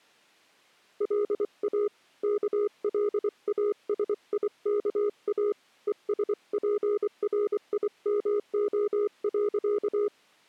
Morse code, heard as a keyed tone, hand-sent with a paddle, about 24 wpm, 410 Hz. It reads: LA KLASIKA ESPRIMO.